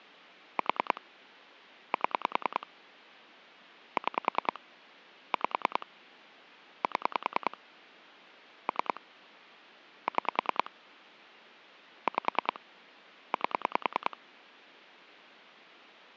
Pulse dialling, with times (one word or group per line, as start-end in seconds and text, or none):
0.6-1.0 4
1.9-2.7 7
4.0-4.6 6
5.3-5.9 5
6.8-7.6 7
8.7-9.0 3
10.1-10.7 6
12.1-12.6 5
13.3-14.2 8